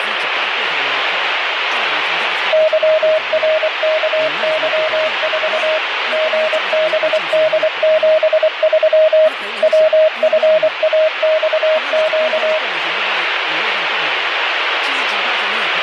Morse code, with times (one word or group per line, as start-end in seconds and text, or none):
2.5-5.8 YRKY4
6.1-9.3 GBD73
9.6-12.6 WFAXQ